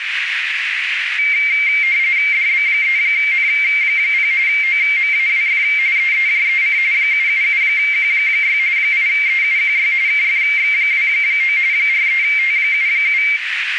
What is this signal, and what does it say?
RTTY (45.45 baud, 170 Hz shift), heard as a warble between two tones, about 2200 Hz centre, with radio static and a narrow filter. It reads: DB3N0 OMAWF EEJEC 777Q6 8EUQY KFX29 43T77